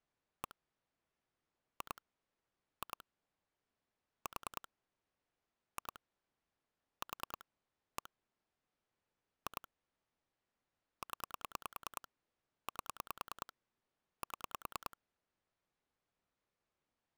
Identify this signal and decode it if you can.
Pulse dialling, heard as clicks on a phone line, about 10 pulses a second. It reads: 1 2 2 4 2 4 1 2 0 8 7